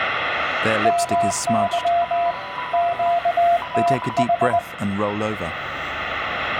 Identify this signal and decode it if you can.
Morse code, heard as two keyed tones, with radio static and room echo. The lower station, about 20 wpm, 690 Hz: MY QTH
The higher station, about 15 wpm, 990 Hz: CQ DE